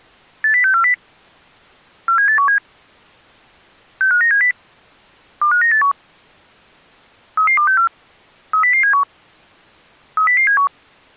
Five-tone selective call (CCIR), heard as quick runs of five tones, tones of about 100 ms. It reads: 80640 47817 65970 25981 33264 30071 30071